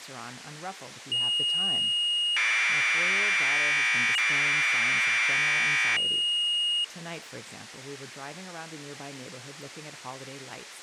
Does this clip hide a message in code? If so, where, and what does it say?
Yes: Commodore tape loading (standard loader) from 1.1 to 6.8 s, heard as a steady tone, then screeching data, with speech in English.